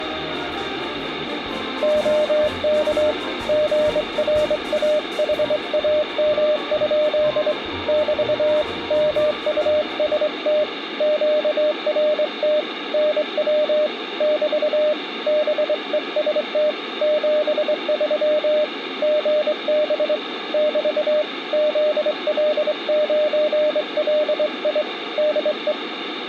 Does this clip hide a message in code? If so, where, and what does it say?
Yes: Morse code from 1.8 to 25.8 s, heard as a keyed tone, hand-sent with a straight key, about 23 wpm, 610 Hz, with radio static. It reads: OK GRAHAM? <BT> MUST QRT NW <BT> BEST 73 GB <BT> ZL9LI DE